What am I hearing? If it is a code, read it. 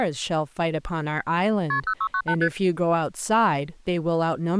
Multi-frequency trunk signalling (R1, as on North American trunks), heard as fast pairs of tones, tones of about 70 ms, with speech in English. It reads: KP 0698 ST